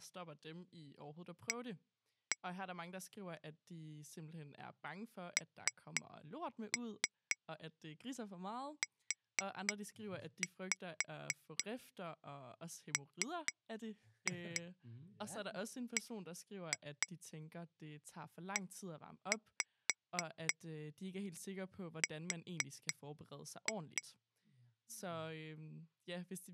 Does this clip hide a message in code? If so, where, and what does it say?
Yes: tap code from 1.5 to 24.0 s, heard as taps on glass, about 4 knocks a second, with speech in Danish. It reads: A NUMBER